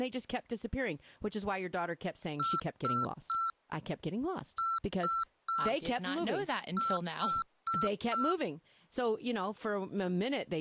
Beep code, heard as beeps from a small speaker, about 1340 Hz, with speech in English. 3-3-4. In Phoenix BIOS tables: video failure.